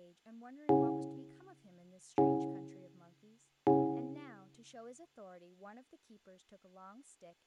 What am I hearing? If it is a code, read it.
Clock strike, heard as a bell, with room echo and speech in English. 3. Three o'clock.